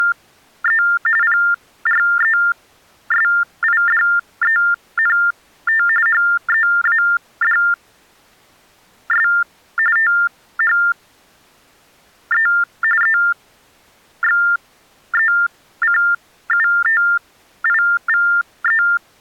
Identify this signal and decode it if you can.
TTY/TDD text telephone tones (45.45 baud Baudot), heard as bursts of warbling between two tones, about 400 Hz shift, 1600 Hz centre. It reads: … PRESIDENT HEADS THE EXECUTIVE